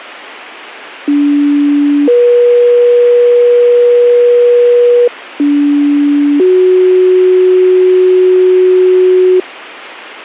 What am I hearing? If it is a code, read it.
Two-tone page, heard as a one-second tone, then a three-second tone, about 290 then 480 Hz, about 290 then 370 Hz.